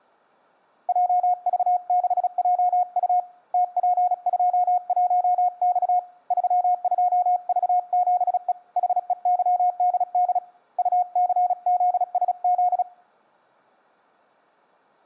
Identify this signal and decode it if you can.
Morse code, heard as a keyed tone, hand-sent with a paddle, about 36 wpm, 720 Hz. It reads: JV6JU TP21X 32V7E HEYDD UCZSZ